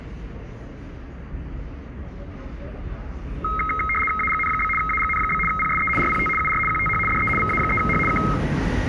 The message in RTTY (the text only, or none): AGN? AGN? PSE RPT UR QTH DE VA3H K